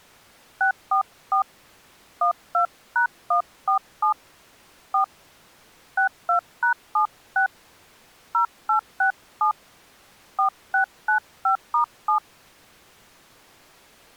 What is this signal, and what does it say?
DTMF, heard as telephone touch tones, dialled by hand, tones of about 100 ms. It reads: 644 12#147 4 62#76 0867 4695*7